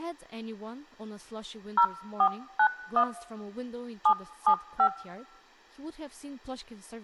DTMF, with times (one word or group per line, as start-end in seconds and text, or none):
1.8-3.0 0491
4.1-4.9 775